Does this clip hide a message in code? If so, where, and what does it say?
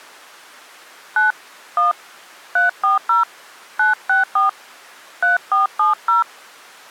Yes: DTMF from 1.2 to 6.2 s, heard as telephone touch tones, dialled by hand, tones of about 140 ms. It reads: 9 1 340 964 3470